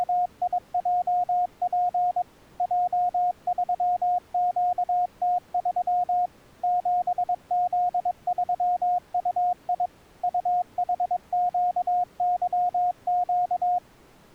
Morse code, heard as a keyed tone, machine-sent, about 22 wpm, 720 Hz. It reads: … J3QT3 7Z3UI UHQYQ